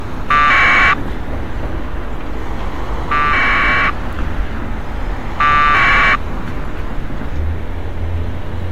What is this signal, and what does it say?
Packet radio (AX.25, as in APRS), 1200 baud, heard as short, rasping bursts, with street noise.